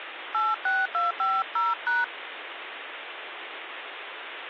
DTMF, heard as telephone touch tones, dialled by hand, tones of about 200 ms, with phone line noise. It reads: 86250#